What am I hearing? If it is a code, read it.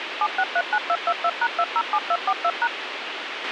DTMF, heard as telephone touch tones, dialled by machine, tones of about 60 ms, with radio hiss and a squelch burst at the end. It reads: 7639222#207242#